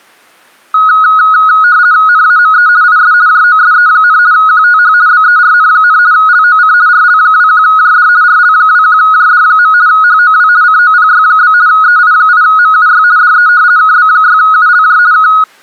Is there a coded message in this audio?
Yes: RTTY (50 baud, 170 Hz shift) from 0.7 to 15.4 s, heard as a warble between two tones, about 1360 Hz centre. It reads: NAME IS JOSE, QTH BERN, LOC RL21JD RL21JD. HOW COPY? EI8MUY DE KB6ULJ K